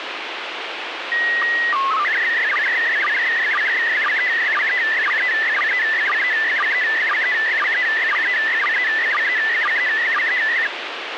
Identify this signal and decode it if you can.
SSTV (slow-scan television), PD 120, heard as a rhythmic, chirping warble, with radio hiss.